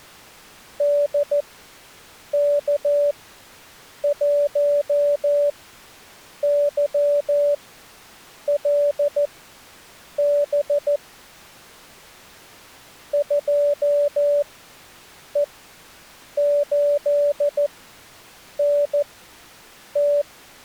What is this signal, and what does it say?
Morse code, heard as a keyed tone, machine-sent, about 14 wpm, spaced as for 7 wpm, 580 Hz. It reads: DK1YLB 2E8NT